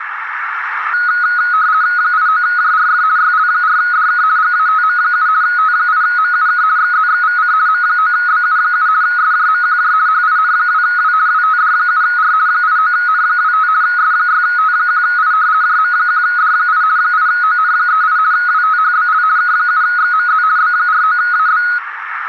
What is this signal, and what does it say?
RTTY (50 baud, 170 Hz shift), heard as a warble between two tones, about 1360 Hz centre, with radio static and a narrow filter. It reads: 89JRF YL4DK GATM7 T8MUK XZXVC M9BU7 SJMQJ HIN2W WTD7R 89N25 S6T1I JM1D8 8ON38 WTHBL K7XMZ B49AB